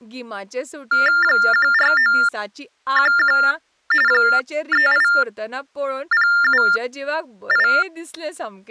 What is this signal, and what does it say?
TTY/TDD text telephone tones (45.45 baud Baudot), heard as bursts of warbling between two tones, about 400 Hz shift, 1600 Hz centre, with speech in Goan Konkani. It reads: 14911 38078